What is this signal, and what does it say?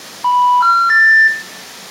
Telephone call progress tone (North American plan), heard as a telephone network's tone, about 980, 1370, 1800 Hz, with room echo. Special information tone.